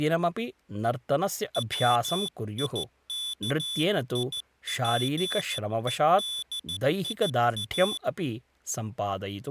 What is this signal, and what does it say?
Morse code, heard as a high beeper, hand-sent with a paddle, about 14 wpm, 3450 Hz, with speech in Sanskrit. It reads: WIKIPEDIA